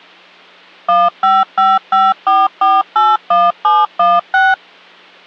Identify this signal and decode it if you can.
DTMF, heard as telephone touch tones, dialled by machine, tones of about 200 ms. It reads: 15554481716